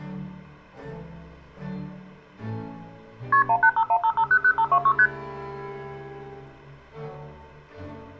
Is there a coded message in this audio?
Yes: multi-frequency trunk signalling (R1, as on North American trunks) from 3.3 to 5.1 s, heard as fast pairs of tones, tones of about 70 ms, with room echo. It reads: KP 18515500526 ST